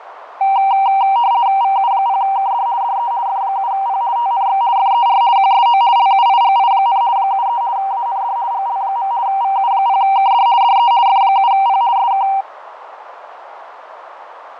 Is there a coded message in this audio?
Yes: RTTY (50 baud, 170 Hz shift) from 0.4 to 12.4 s, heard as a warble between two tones, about 860 Hz centre, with radio static, fading and a narrow filter. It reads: VU0KD DE F7P TNX FER QSO LUIGI, 73 AND GL. VU0KD DE F7P SK